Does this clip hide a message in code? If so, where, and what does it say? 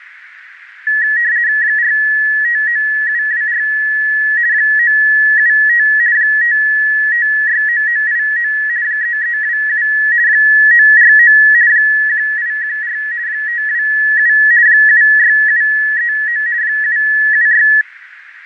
Yes: RTTY (50 baud, 170 Hz shift) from 0.9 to 17.8 s, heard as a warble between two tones, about 1800 Hz centre, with radio static, fading and a narrow filter. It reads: 459724 975 5569989 3327 949 1814 527 76739 776